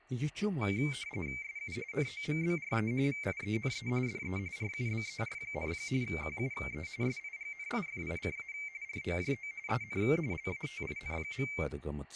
RTTY (45.45 baud, 170 Hz shift), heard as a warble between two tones, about 2200 Hz centre, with room echo and speech in Kashmiri. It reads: SU NOMBRE VIENE DE RUBER, QUE SIGNIFICA ROJO EN LATIN.